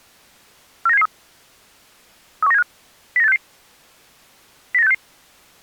Five-tone selective call (EEA), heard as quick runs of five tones, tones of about 40 ms. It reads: 49773 31975 09866 09866